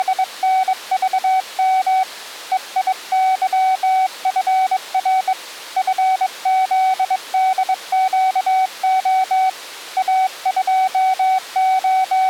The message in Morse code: … EIYFR FZDQO …

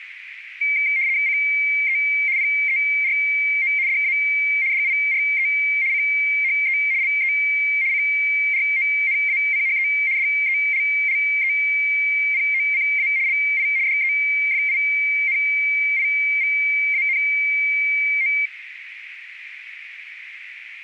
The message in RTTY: CE PERO DA DIRE CHE LE CRONACHE DELLEPOCA LI DEFINIVANO

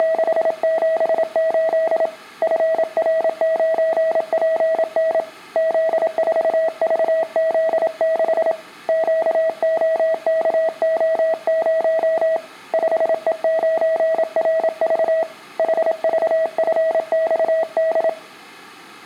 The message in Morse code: … FR9PN Z4VZ6 QOKO0 5E9RV HVFXD

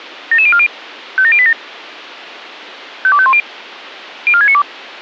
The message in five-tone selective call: 77040 57087 52510 04692

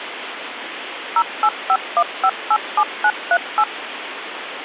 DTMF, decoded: 0851587938

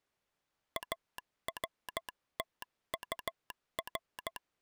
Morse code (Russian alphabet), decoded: АРТУР

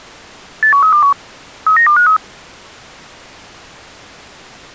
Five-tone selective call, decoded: 81321 39253

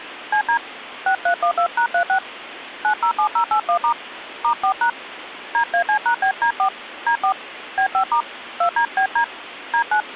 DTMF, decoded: CD 6312#36 907081* *4# DAC#BD4 D4 B5* 2DBD D9

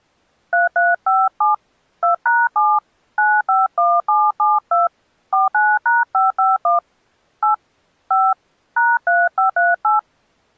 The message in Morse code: none

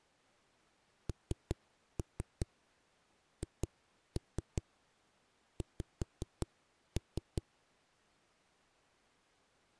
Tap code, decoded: NHX

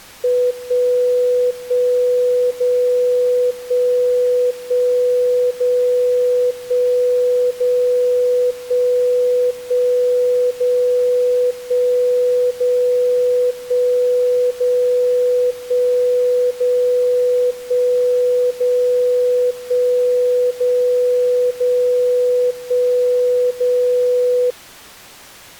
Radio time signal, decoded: 1 1 0 1 1 0 1 0 1 1 0 1 0 1 0 1 0 1 0 1 0 0 1 0

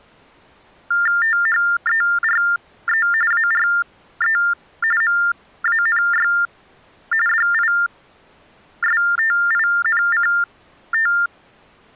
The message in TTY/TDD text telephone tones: THERE ARE MANY DISTINCT

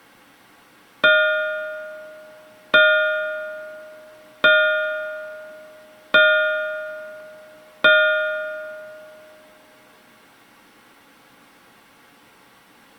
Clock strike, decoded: 5

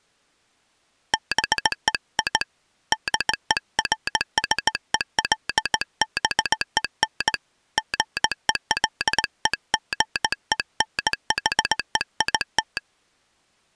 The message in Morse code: BEI DERSELBEN GELEGENHEIT

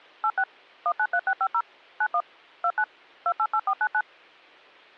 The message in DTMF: 86 193650 91 29 288499

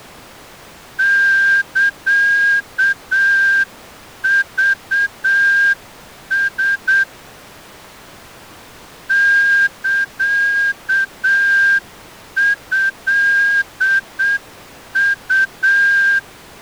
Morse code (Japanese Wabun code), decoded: サクラ サトウ

